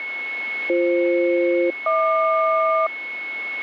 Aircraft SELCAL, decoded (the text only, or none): BF-HQ